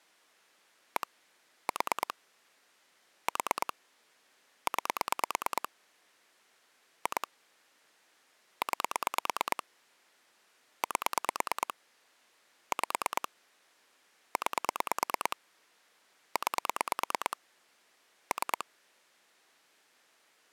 Pulse dialling, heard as clicks on a phone line, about 9 pulses a second. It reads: 1 4 4 9 2 9 8 5 9 9 3